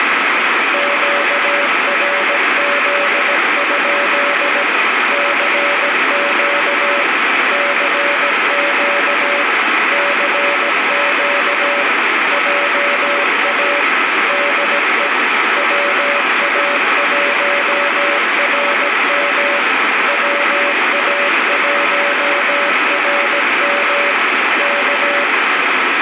Morse code, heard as a keyed tone, machine-sent, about 17 wpm, 570 Hz, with heavy radio static. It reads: QRZ? CQ CQ CQ JA DE WA1RM WA1RM K